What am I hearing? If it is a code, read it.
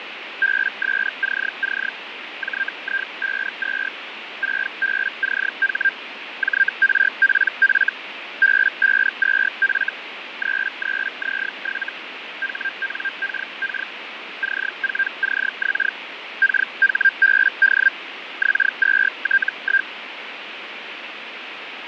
Hellschreiber (Feld-Hell, 122.5 baud), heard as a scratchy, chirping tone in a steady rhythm, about 1600 Hz, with radio static and fading. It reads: BSCC JI52 6BCH JRPF B52F 33Z7 HNKK C4CX KHBD X2T1